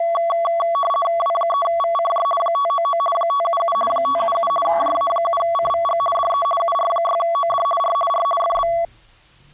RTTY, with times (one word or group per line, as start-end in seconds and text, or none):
1.2-2.2 W3VCJ
2.4-3.0 599
3.1-3.8 577
3.9-4.5 577
4.7-6.0 JA7CVG
6.2-6.5 DE
6.6-7.7 UR6OD
7.8-8.0 R
8.1-8.2 R
8.4-8.7 FB